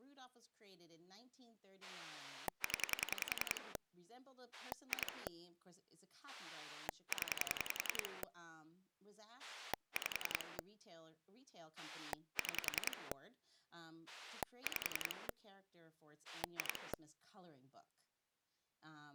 Pulse dialling, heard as a rotary dial, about 10 pulses a second, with speech in English. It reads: 0 2 0 5 6 5 2